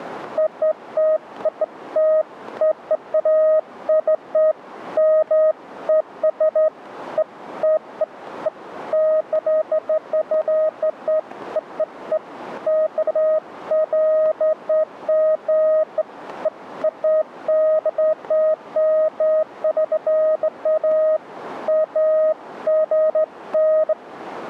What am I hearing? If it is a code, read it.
Beeps of irregular length. There is no code.